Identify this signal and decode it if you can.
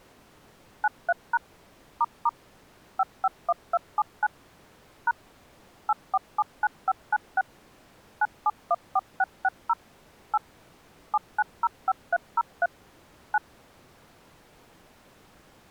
DTMF, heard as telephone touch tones, dialled by machine, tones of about 40 ms. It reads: 93# ** 551279 # 8479596 9714660 8 7905303 9